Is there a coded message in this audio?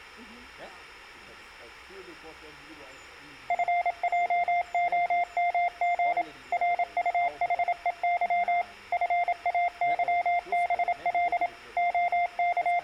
Yes: Morse code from 3.4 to 12.8 s, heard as a keyed tone, machine-sent, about 27 wpm, 700 Hz, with room echo. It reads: FJOMG RUHEY FAYBL …